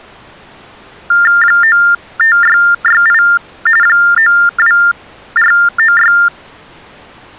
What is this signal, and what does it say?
TTY/TDD text telephone tones (45.45 baud Baudot), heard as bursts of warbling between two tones, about 400 Hz shift, 1600 Hz centre. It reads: 95668 92496